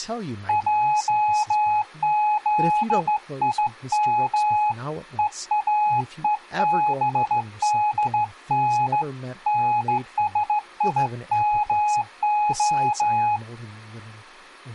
Morse code (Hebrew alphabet), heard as a keyed tone, hand-sent with a straight key, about 15 wpm, 840 Hz, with speech in English. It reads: עזים ואובדן נשימה